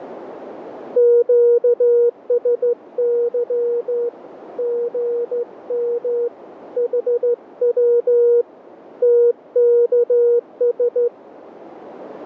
Morse code, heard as a keyed tone, hand-sent with a straight key, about 14 wpm, 480 Hz, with radio static and a narrow filter. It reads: QSY GM HW TKS